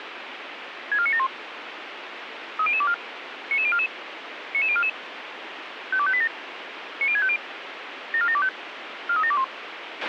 Five-tone selective call (ZVEI), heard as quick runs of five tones, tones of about 70 ms, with radio hiss and a squelch burst at the end. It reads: 64971 30024 99044 99044 52587 90650 74725 43721